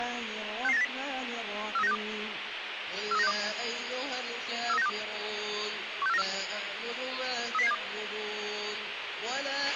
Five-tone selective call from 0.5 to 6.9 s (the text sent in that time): 66980 43962 43962 43962 16494